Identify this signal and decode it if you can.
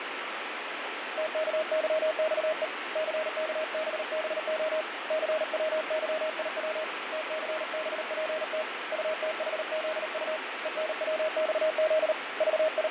Morse code, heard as a keyed tone, hand-sent with a paddle, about 38 wpm, 630 Hz, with heavy radio static and fading. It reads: TKYXE CKBBO CWYIW TCBPT UTHZU ENWXZ …